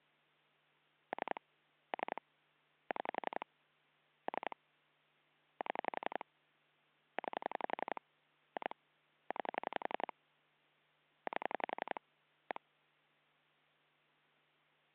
Pulse dialling, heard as clicks on a phone line, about 11 pulses a second. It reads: 3 3 6 3 7 9 2 9 8 1